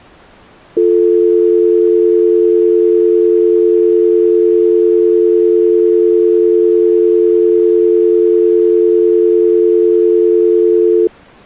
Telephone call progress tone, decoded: dial tone

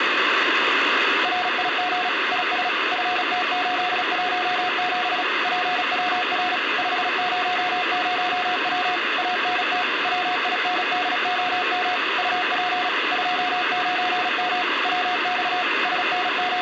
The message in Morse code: RIG IS FT817 PWR 500W ANT WINDOM UP 29M WX …

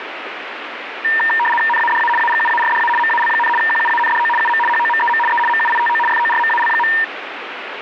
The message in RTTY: NADA AGUARDA MAL, QUANDO UM HOMEM E MUITO FORMAL.

